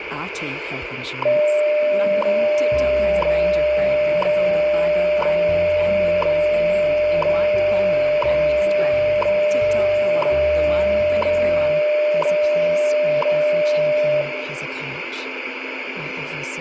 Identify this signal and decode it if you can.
Radio time signal (WWV, Colorado), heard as ticks, one a second, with radio static.